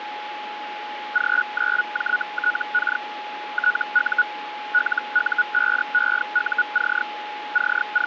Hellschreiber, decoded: G9JTK TU LU5EUC …

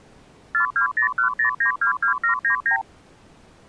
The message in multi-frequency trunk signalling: 42010922799

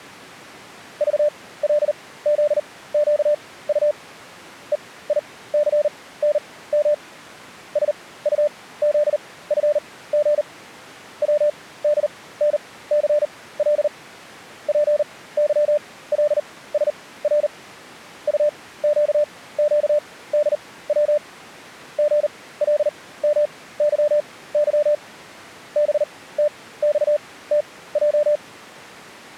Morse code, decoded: VLZQU EICNM SUZFG WDNCL PYLSR UQQDW GLMYY BTXTJ

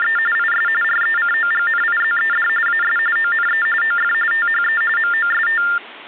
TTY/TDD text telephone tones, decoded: … IS RECOGNIZED AS ONE OF THE MOST

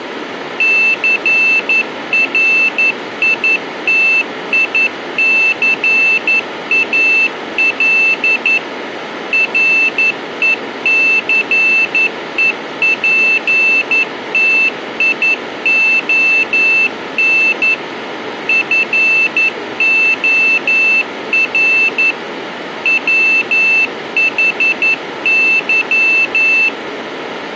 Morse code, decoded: CRITICAL RECEPTION FOR WHY

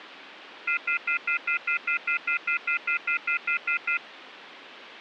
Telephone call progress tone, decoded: off-hook warning tone

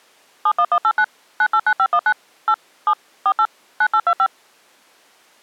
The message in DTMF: 71189 989519 8 7 48 9825

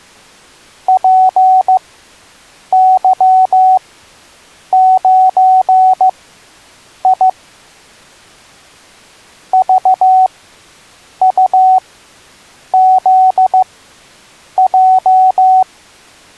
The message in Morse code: PY9I VUZJ

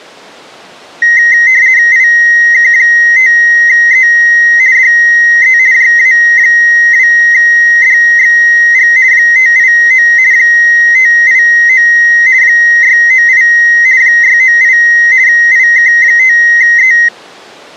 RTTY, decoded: IK5E DE JA2DXG 589 589 698 698 IK5E

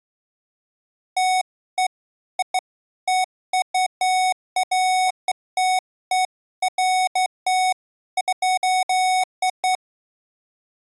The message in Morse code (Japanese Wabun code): none

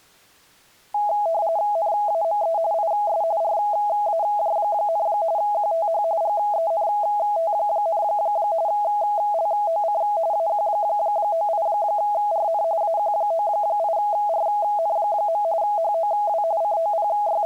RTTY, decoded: NAME IS RAJ, QTH GENT, LOC AQ98RN AQ98RN. HOW …

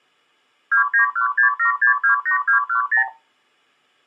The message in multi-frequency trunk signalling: 29167628210

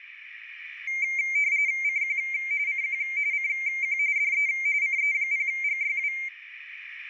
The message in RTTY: CQ CQ CQ DE CE0GYW

